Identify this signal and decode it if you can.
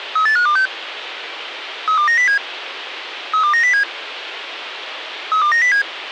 Five-tone selective call (CCIR), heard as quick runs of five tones, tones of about 100 ms, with radio hiss. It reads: 38526 32907 32907 32907